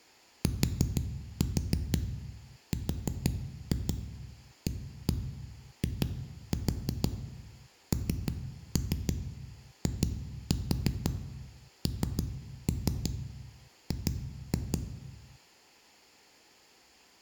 Tap code, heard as knocks on a wall, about 6 knocks a second, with room echo. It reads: TRAINING